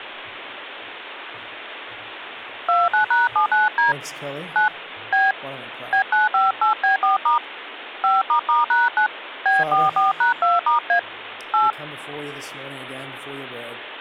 DTMF, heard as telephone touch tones, dialled by hand, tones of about 150 ms, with phone line noise. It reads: 29#79D 9 B B958B4* 5**#9 B44#2*A 8